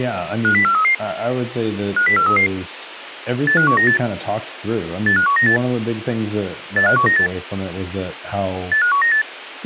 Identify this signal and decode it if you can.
Five-tone selective call (CCIR), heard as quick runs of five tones, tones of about 100 ms, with speech in English. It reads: 50433 50433 85198 85198 85198 85198